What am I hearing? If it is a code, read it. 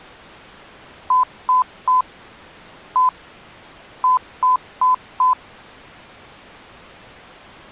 Beep code, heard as beeps, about 1010 Hz. 3-1-4. In Phoenix BIOS tables: interrupt mask register failure.